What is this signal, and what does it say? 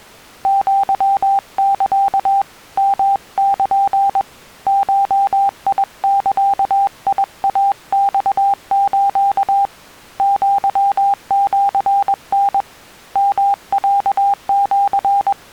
Morse code (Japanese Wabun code), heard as a keyed tone, hand-sent with a paddle, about 21 wpm, 800 Hz. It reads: アサ ヨル ゴザイマス アシタ …